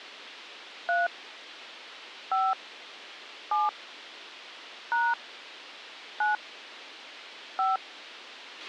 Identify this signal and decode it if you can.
DTMF, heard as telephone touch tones, dialled by hand, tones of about 180 ms, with a squelch burst at the end. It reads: 3 5 7 # 9 5